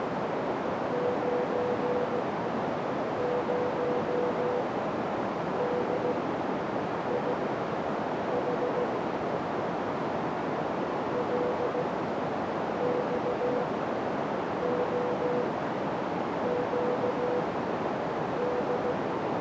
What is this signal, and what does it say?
Morse code, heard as a keyed tone, machine-sent, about 16 wpm, spaced as for 7 wpm, 490 Hz, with heavy radio static and a narrow filter. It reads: 90DIH LXOQD